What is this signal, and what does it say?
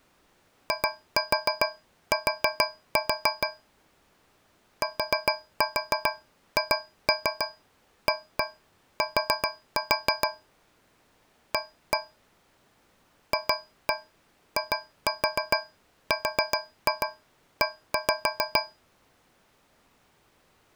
Tap code, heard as taps on a metal pipe, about 7 knocks a second. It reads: IT THAT A FIRE